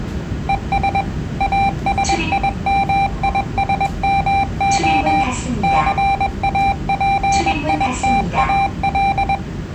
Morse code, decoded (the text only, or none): ES ASIMISMO CAPITAL